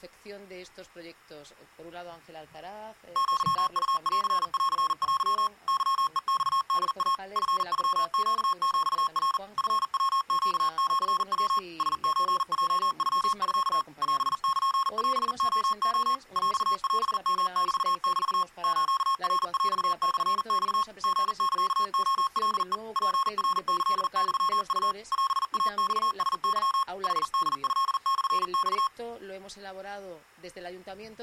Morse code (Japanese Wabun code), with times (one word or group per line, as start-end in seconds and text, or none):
3.2-5.5 アウンンテ
5.7-7.1 ケヘマホイ
7.4-9.4 チノネヒナ
9.6-11.6 チヤネシヤ
11.8-13.8 ラソヲノミ
14.0-16.1 オルオレレ
16.4-18.4 ヰオヨメメ
18.6-20.8 スナヰモマ
21.0-22.7 リサレカヘ
23.0-24.9 ツナキユウ
25.1-26.8 オイマラケ
27.0-28.9 ヌホトモマ